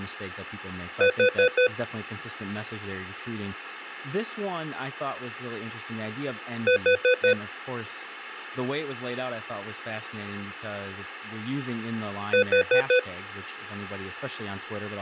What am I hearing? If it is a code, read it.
Alarm pattern, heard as an alarm's beeps, played three times, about 500 Hz, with speech in English. Temporal four. Carbon monoxide.